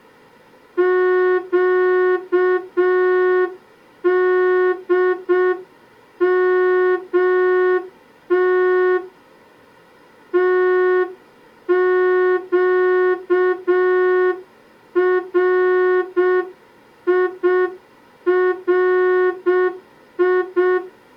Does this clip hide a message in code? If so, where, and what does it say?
Yes: Morse code (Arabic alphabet) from 0.7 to 20.8 s, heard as a horn, hand-sent with a straight key, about 6 wpm. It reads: قدمت تقريري